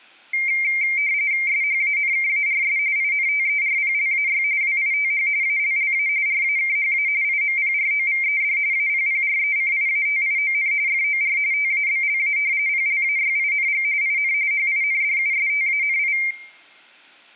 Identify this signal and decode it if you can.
RTTY (45.45 baud, 170 Hz shift), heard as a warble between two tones, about 2200 Hz centre. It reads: SHANKARS INTERPLAY WITH ALLA RAKHA IMPROVED APPRECIATION FOR TABLA PLAYING IN HINDUSTANI